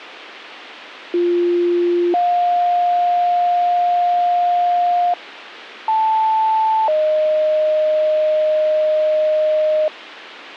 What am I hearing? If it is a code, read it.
Two-tone page, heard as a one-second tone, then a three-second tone, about 350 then 710 Hz, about 880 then 620 Hz.